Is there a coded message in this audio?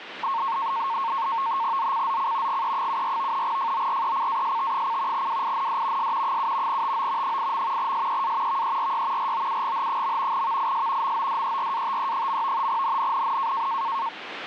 Yes: NAVTEX (SITOR-B), 100 baud, 170 Hz shift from 0.2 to 14.1 s, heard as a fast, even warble, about 1000 Hz centre, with radio static. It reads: ZCZC GE74 FORECAST: WIND S 7 TO 8. SEA VERY ROUGH. VIS MODERATE. NNNN